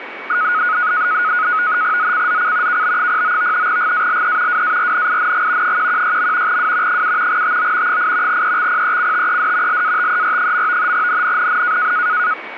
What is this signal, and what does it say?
NAVTEX (SITOR-B), 100 baud, 170 Hz shift, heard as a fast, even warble, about 1360 Hz centre, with radio static and a steady whistle near 2250 Hz. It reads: ZCZC KB09 GALE WARNING 116. W 7 TO 8 EXPECTED LATER. NNNN